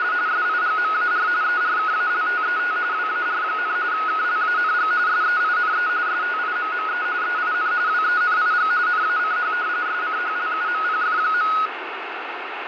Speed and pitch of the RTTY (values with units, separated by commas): 45.45 baud, 170 Hz shift, 1360 Hz centre